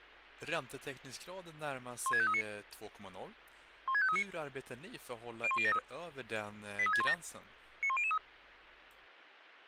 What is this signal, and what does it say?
Five-tone selective call (ZVEI), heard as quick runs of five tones, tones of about 70 ms, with speech in Swedish. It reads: 16539 16539 01073 83617 91003